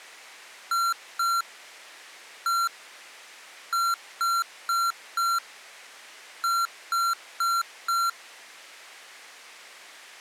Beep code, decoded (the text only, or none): 2-1-4-4